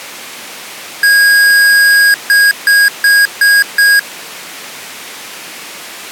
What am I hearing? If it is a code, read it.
Beep code, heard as beeps from a small speaker, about 1650 Hz. 1 long, 5 short.